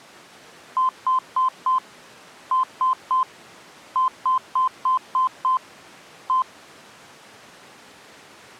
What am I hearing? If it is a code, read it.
Beep code, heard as beeps, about 1030 Hz. 4-3-6-1.